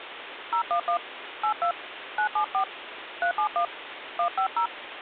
DTMF, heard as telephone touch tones, dialled by hand, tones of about 90 ms, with phone line noise. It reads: 011 82 974 371 150